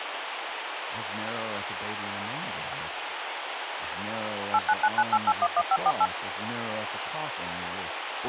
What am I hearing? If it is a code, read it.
DTMF, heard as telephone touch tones, dialled by machine, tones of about 50 ms, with phone line noise and speech in English. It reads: 89998811548